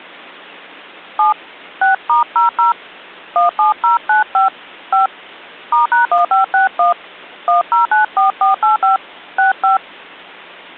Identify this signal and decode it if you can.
DTMF, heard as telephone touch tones, dialled by hand, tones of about 130 ms. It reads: 7 6*00 17095 5 *#1561 1094485 65